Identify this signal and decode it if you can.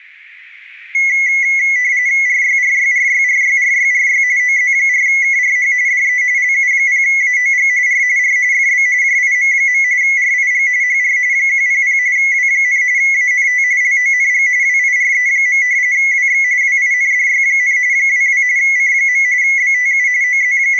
RTTY (45.45 baud, 170 Hz shift), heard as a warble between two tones, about 2050 Hz centre, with room echo. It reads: RYRYRYRYRYRY OZ4KRH DE LU0AOG R R FB JIM. RIG HR 100 W, ANT LONG WIRE. WX WINDY, 22 C. BTU …